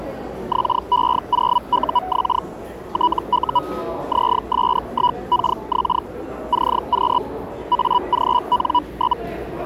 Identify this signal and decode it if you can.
Hellschreiber (Feld-Hell, 122.5 baud), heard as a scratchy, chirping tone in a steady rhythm, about 980 Hz, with the noise of a subway station. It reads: XE0UX TU ZS1KX CQ AGN?